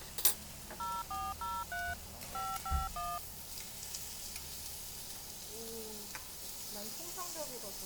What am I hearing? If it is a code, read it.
DTMF, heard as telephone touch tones, dialled by machine, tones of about 220 ms, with the noise of a restaurant. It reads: 0403 551